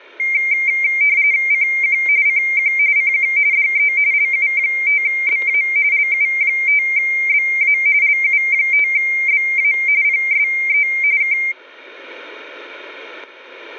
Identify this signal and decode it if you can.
RTTY (45.45 baud, 170 Hz shift), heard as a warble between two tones, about 2200 Hz centre, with static crashes. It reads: CQ CQ CQ DE LU5BA LU5BA LU5BA PSE K